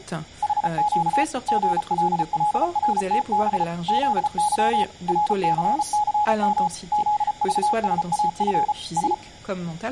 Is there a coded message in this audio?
Yes: Morse code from 0.4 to 9.2 s, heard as a keyed tone, machine-sent, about 34 wpm, 840 Hz, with speech in French. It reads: HQ GLLRTB ZY RCCM ZVSAF S